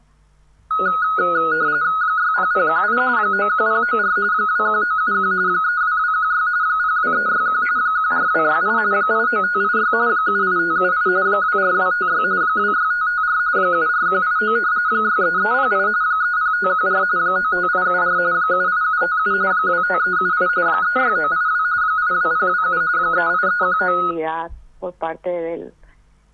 RTTY (45.45 baud, 170 Hz shift), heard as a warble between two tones, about 1360 Hz centre. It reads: 60018 91094 21971 32216 02361 14268 89586 78578 24256 26554 74189 63308 30514 95874 78757 25378 36982 82027 38319